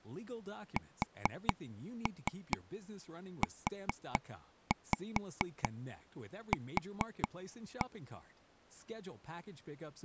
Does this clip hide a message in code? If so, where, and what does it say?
Yes: tap code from 0.8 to 7.8 s, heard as taps on a table, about 4 knocks a second, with speech in Italian. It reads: SUQ